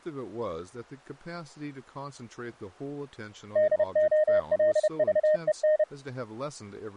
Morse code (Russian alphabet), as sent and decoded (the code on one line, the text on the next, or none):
-.. --- .-.. ...- . -.
ДОЛЖЕН